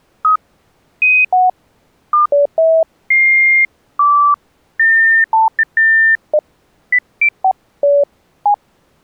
Electronic bleeps of random pitch and length. There is no code.